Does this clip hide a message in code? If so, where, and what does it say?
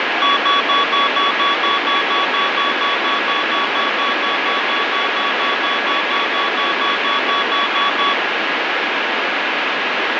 No, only evenly repeated beeps, with heavy radio static.